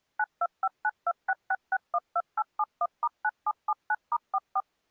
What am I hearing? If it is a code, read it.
DTMF, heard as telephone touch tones, dialled by machine, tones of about 50 ms. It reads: 9259266612871*9779*44